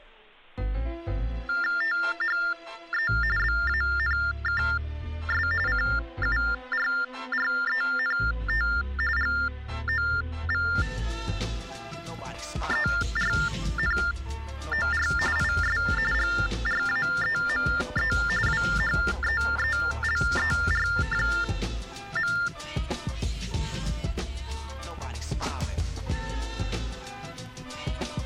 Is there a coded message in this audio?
Yes: TTY/TDD text telephone tones (45.45 baud Baudot) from 1.5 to 22.5 s, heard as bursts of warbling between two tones, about 400 Hz shift, 1600 Hz centre. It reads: THE BANKS CURRENT GOVERNOR IS GRAEME WHEELER.